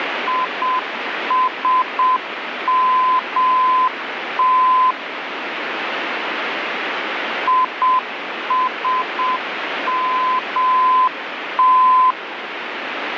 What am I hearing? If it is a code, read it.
Morse code, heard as a keyed tone, machine-sent, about 7 wpm, 1020 Hz, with radio static. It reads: ISMT ISMT